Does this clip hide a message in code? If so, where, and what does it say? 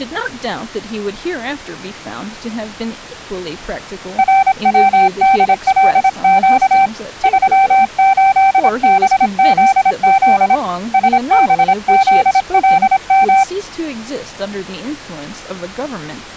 Yes: Morse code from 4.1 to 13.5 s, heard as a keyed tone, hand-sent with a paddle, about 26 wpm, 780 Hz, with speech in English. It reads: RWDLQ 38BZZ SBZLM